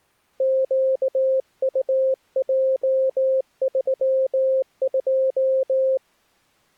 Morse code, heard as a keyed tone, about 19 wpm, 530 Hz. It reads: QUJ32